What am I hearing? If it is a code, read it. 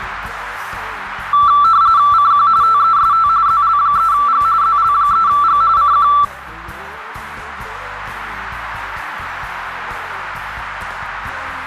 RTTY (45.45 baud, 170 Hz shift), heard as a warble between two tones, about 1240 Hz centre, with radio static. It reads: CQ TEST ZL3G ZL3G CQ